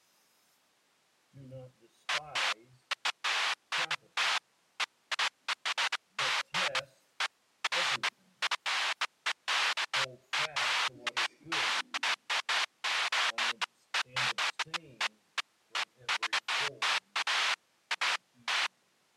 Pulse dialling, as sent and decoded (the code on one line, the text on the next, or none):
none